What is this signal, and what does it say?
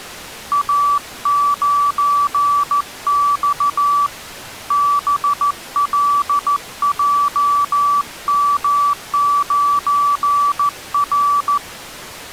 Morse code, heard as a keyed tone, hand-sent with a paddle, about 14 wpm, 1150 Hz. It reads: A9X BLJM9R